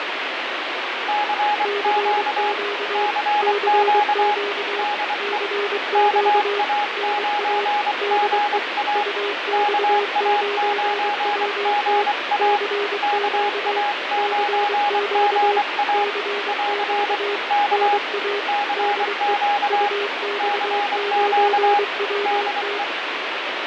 Morse code, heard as two keyed tones, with radio static. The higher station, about 24 wpm, 830 Hz: CQ CQ DE KA9GA KA9GA KA9GA <AR> K CQ CQ DE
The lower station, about 23 wpm, 410 Hz: CQ CQ CQ NA DE UX9WT CQ CQ CQ NA DE UX9WT